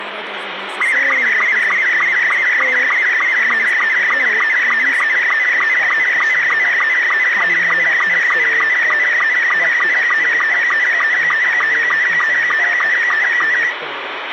SSTV (slow-scan television), Robot 72, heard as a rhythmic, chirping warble, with radio hiss, a squelch burst at the end and room echo.